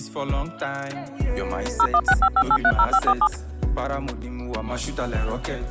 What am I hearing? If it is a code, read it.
DTMF, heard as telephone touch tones, dialled by machine, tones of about 60 ms. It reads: 01655830547